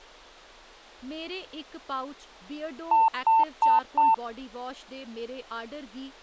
Beep code, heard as beeps, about 900 Hz, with speech in Dogri. 4 short. In AMI BIOS tables: system timer failure; in Dell tables: memory read or write failure.